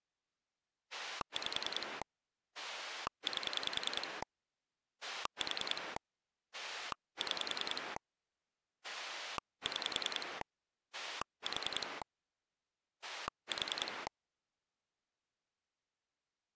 Pulse dialling, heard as a rotary dial, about 10 pulses a second. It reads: 5 8 4 6 6 4 4